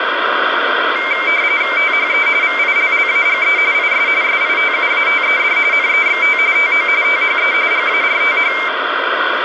RTTY (45.45 baud, 170 Hz shift), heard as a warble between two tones, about 2200 Hz centre, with radio static. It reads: THE VILLAGE IS SITUATED NEXT TO THE GARTH